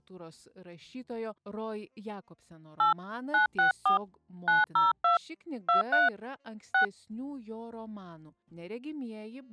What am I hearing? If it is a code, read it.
DTMF, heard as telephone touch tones, dialled by hand, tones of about 140 ms. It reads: 8 964 902 23 6